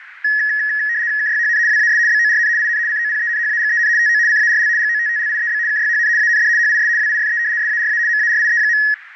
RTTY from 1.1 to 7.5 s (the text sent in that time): KYHN WAS BORN IN COPENHAGEN TO CARL GOTTLIEB KYHN AND HIS WIFE